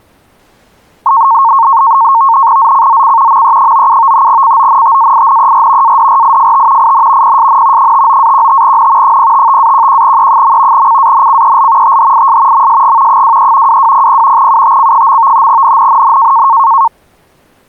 NAVTEX (SITOR-B), 100 baud, 170 Hz shift, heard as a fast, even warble, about 1000 Hz centre. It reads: ZCZC ME97 CONTAINER ADRIFT IN PSN 59-15N 055-11E. CANCEL THIS MSG 23 2200 UTC. NNNN